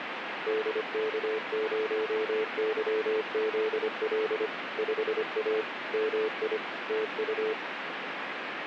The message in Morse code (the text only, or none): DK0YZL 5A MI TU